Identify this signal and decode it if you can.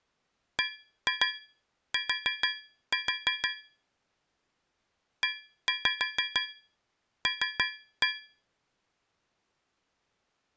Tap code, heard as taps on a metal pipe, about 6 knocks a second. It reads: BT EL